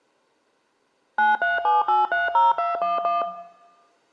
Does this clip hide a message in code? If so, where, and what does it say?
Yes: DTMF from 1.2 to 3.2 s, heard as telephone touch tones, dialled by machine, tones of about 170 ms, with room echo. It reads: 937830211